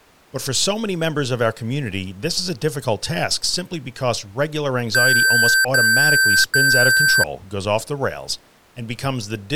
Beep code, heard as beeps from a small speaker, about 1550 Hz, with speech in English. 3 long. In IBM BIOS tables: keyboard card error.